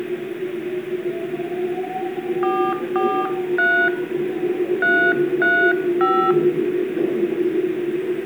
DTMF, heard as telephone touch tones, dialled by hand, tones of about 300 ms, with room echo and the noise inside a subway train. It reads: 443 335